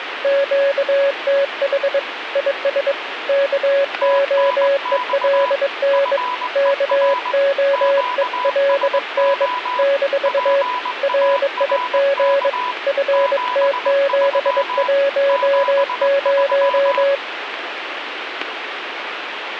Morse code, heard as two keyed tones, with radio static. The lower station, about 22 wpm, 560 Hz: QTH IS KOELN KOELN - RIG FT710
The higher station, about 20 wpm, 990 Hz: TNX FER QSO PARK 73 73